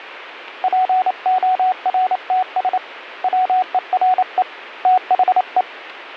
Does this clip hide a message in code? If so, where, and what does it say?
Yes: Morse code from 0.6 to 5.7 s, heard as a keyed tone, hand-sent with a paddle, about 28 wpm, 740 Hz. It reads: PORTS WERE THE